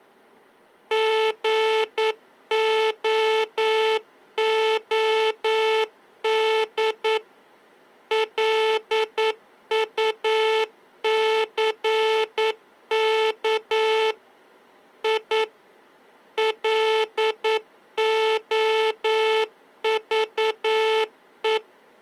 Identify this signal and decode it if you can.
Morse code, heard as a buzzer, machine-sent, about 9 wpm. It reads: GOOD LUCK I LOVE